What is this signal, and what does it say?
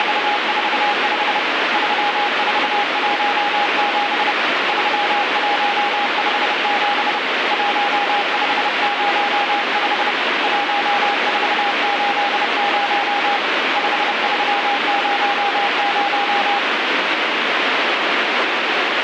Morse code, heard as a keyed tone, hand-sent with a paddle, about 30 wpm, 820 Hz, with heavy radio static. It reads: … 3417 3157 1505 1480 5300